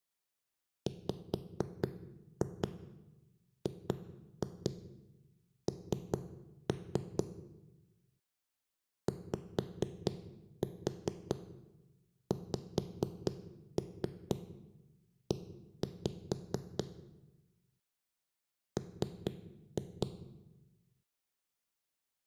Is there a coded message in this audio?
Yes: tap code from 0.9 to 20.1 s, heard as knocks on a wall, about 4 knocks a second, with room echo. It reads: WGN YXE M